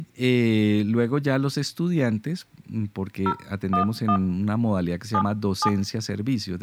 DTMF, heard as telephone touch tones, dialled by hand, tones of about 80 ms, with room echo and speech in Spanish. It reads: 011 77